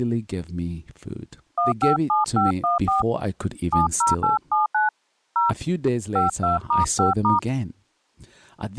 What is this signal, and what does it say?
DTMF, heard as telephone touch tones, dialled by hand, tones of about 150 ms, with speech in English. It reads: 157514 70879 0 52*5*